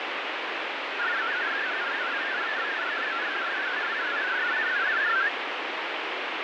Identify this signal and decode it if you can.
Multi-tone FSK (Olivia or MFSK type), about 500 Hz wide, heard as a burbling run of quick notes, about 62.5 baud, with heavy radio static.